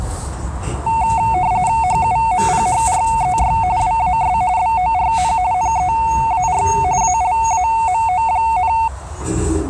RTTY (45.45 baud, 170 Hz shift), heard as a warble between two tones, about 820 Hz centre, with radio static and the noise inside a subway train. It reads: HUMPHREY WAS BORN NEAR ALAMO,